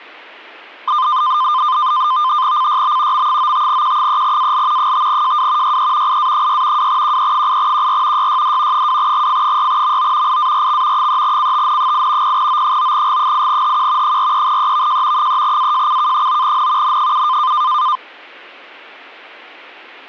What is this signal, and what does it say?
NAVTEX (SITOR-B), 100 baud, 170 Hz shift, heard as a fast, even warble, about 1120 Hz centre. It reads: CYB M95Q3AL 5JW YE IA6 2QE8QR YYD 2GF6MO IARX 3CTN8 0O9G8HQ 43EVJ 3AJCK9N N7